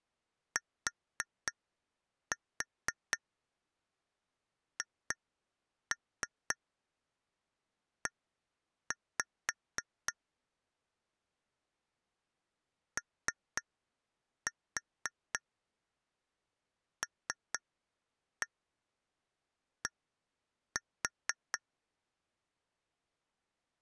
Tap code, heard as taps on glass, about 3 knocks a second. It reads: THE OLD